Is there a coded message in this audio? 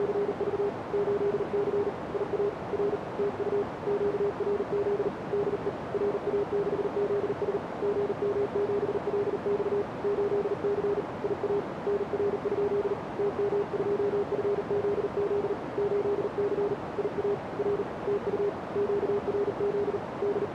Yes: Morse code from 0.0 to 20.5 s, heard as a keyed tone, hand-sent with a paddle, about 39 wpm, 410 Hz, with radio static and a narrow filter. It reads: … 8C IA R TU QRZ DE RA6ZS GM7LX 8C IA NR? TM2FZZ 8C IA R TU QRZ …